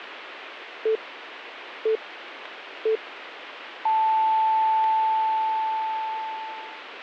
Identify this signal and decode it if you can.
Radio time signal (three low pips and a long one an octave up, as on NHK), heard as pips.